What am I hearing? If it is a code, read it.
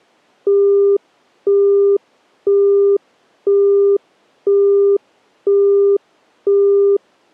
Telephone call progress tone (single-tone plan, as in Europe, Japan and elsewhere), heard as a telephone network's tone, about 400 Hz, 0.5 s on and 0.5 s off. Busy tone.